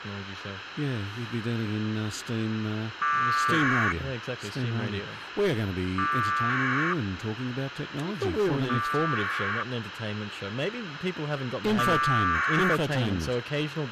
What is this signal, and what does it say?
Packet radio (AX.25, as in APRS), 1200 baud, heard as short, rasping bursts, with radio hiss and a squelch burst at the end.